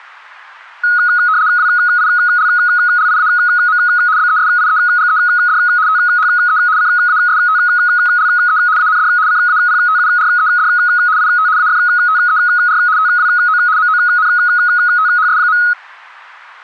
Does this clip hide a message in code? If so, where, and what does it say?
Yes: RTTY (75 baud, 170 Hz shift) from 0.8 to 15.7 s, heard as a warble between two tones, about 1360 Hz centre, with static crashes. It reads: WILLIAM BESIEGED THE CASTLE AND CAPTURED IT AFTER TWO MONTHS.